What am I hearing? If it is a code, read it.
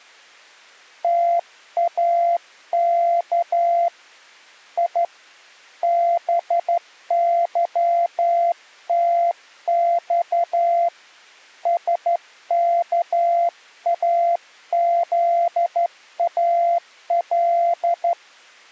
Morse code (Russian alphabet), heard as a keyed tone, hand-sent with a straight key, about 12 wpm, 690 Hz. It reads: ТАК И БЫТЬ СКАЗАЛ